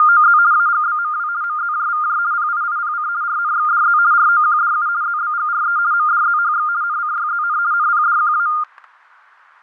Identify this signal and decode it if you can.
RTTY (50 baud, 170 Hz shift), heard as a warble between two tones, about 1310 Hz centre, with fading and static crashes. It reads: … AGBMW MZJVJ PIIPC RNXDZ ROQDU ZBGRE MDZHX NCYZN NPDQA